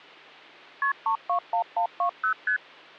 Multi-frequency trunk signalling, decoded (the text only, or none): KP 321120 ST